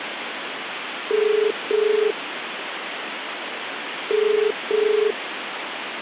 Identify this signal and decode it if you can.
Telephone call progress tone (as in the UK, Ireland, Australia and similar networks), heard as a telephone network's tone, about 430 Hz, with phone line noise. Ringback tone.